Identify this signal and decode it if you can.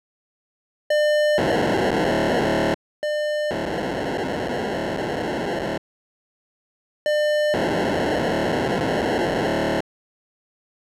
POCSAG pager data (1200 baud), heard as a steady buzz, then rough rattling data.